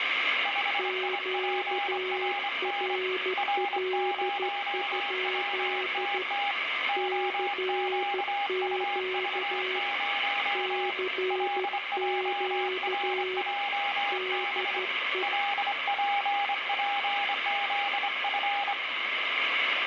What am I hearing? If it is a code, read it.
Morse code, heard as two keyed tones, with radio static and room echo. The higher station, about 25 wpm, 810 Hz: 5IPRN R0WTT OQUV0 LJRJB LPPZF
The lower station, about 13 wpm, 370 Hz: QRL? CQ CQ DE